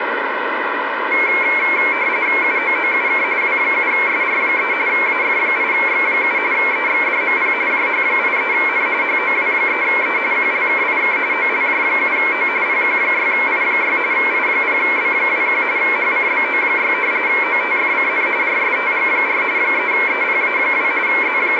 RTTY (45.45 baud, 170 Hz shift), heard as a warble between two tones, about 2250 Hz centre, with radio static. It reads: UOOUK W7SR3 AF8X7 EXDMP JH83N HOW3E QLKIK OLJ7O PQ6I6 I0B21 HCBO6 OTFCN RSTG4 3EPA2 …